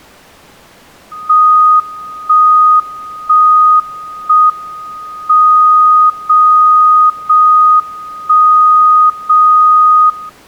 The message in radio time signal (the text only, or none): 1 1 1 M 0 0 1 0 0